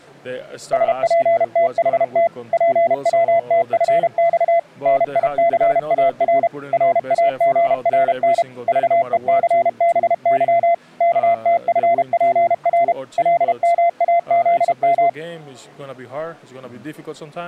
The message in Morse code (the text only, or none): SPTHT PWTFX NICAR RAGRN VECBY KTFPR LMAZM